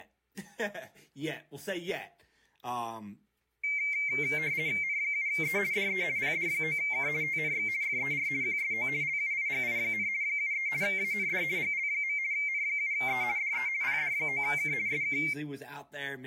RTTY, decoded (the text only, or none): N7E DE PD9K TNX FER QSO LUIGI, 73 AND GL. N7E DE PD9K SK